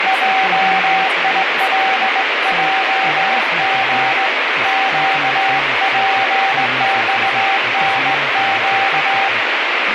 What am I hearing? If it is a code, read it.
Morse code (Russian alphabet), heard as a keyed tone, hand-sent with a straight key, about 19 wpm, 770 Hz, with heavy radio static and speech in English. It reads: ЙИЛЙГ ЩПЬНЩ